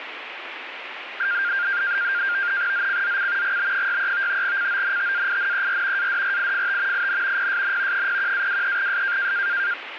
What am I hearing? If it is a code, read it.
NAVTEX (SITOR-B), 100 baud, 170 Hz shift, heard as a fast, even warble, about 1500 Hz centre, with radio static. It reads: ZCZC GB63 CONTAINER ADRIFT IN PSN 01-23S